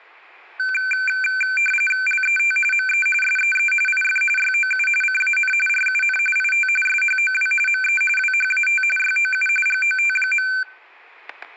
RTTY (45.45 baud, 850 Hz shift), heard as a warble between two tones, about 1950 Hz centre, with static crashes. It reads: LET ME SEE IF YOU CAN RUN IT SHOW ME WHAT YOU GOT.